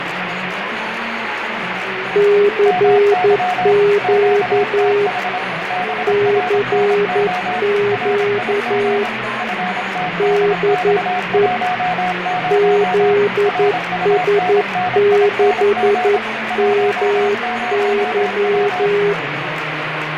Morse code, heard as two keyed tones, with radio static. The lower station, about 11 wpm, 410 Hz: CQ CQ DE ZS6MY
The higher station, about 26 wpm, 730 Hz: MY QTH BRNO RIG FTDX10 RUNNING 10W